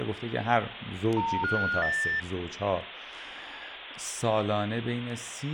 Telephone call progress tone (North American plan), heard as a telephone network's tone, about 910, 1430, 1800 Hz, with phone line noise and speech in Persian. Special information tone.